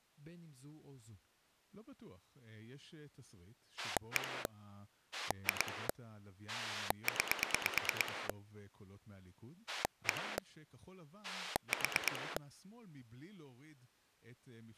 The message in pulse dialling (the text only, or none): 1 2 9 1 4